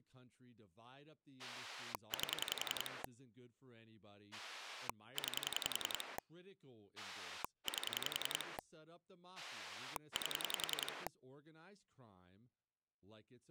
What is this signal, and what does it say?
Pulse dialling, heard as a rotary dial, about 10 pulses a second, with speech in English. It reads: 8 9 8 8